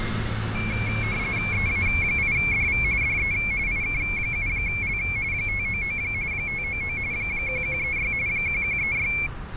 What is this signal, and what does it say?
RTTY (45.45 baud, 170 Hz shift), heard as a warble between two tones, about 2250 Hz centre, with fading and street noise. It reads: EA8DV DE IK7L 599 599 1136 1136